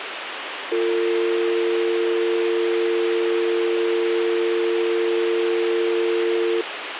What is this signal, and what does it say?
Telephone call progress tone (North American or UK plan), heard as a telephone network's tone, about 350, 450 Hz, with phone line noise. Dial tone.